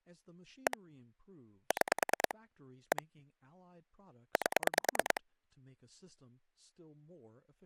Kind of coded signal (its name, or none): pulse dialling